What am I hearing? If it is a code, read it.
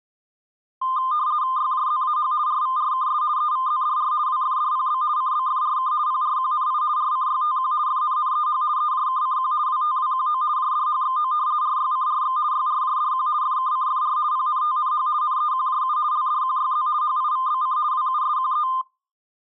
RTTY (50 baud, 170 Hz shift), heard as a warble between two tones, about 1130 Hz centre. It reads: YJZAH RVRKS EVZDR WFDPB CBFRK PRQNI RCYTQ FNNEH EJKCQ WTWQO JDHXO RYCRX YRJDQ FKCFR PNTNH NEQJU LDQYZ HIVBC WUSQE